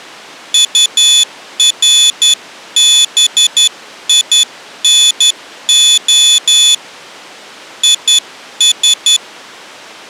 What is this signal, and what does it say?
Morse code, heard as a high beeper, hand-sent with a straight key, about 11 wpm, 3450 Hz. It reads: URBINO IS